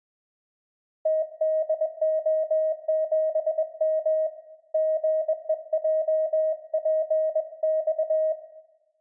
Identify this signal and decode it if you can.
Morse code, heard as a keyed tone, hand-sent with a bug key, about 21 wpm, 630 Hz, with room echo. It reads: TDO7M GEJPX